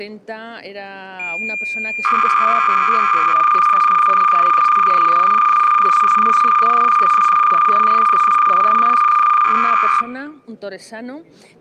Cassette data (Kansas City type), 300 baud, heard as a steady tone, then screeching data.